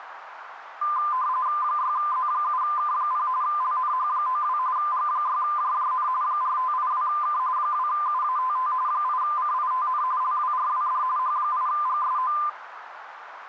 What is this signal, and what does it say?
RTTY (45.45 baud, 170 Hz shift), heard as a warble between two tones, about 1110 Hz centre, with radio static and a narrow filter. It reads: 6Z7K0 LNH92 G6JJN 4582K 2UATT 8CITN LWRWD H8GSO